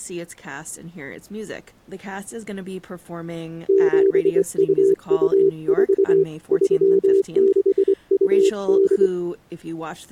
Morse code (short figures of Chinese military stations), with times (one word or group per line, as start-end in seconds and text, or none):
3.7-6.2 7224
6.5-9.1 3628